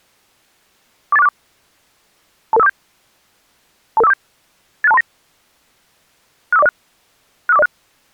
Five-tone selective call (EIA), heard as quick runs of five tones, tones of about 30 ms. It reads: 48464 22547 22547 86239 65406 65406